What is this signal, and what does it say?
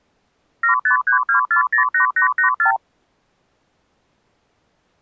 Multi-frequency trunk signalling (R2, with the far end's replies), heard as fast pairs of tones, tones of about 110 ms. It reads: 7532408884